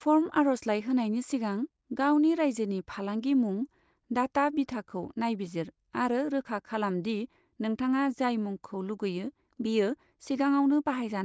Speech in Bodo. There is no code.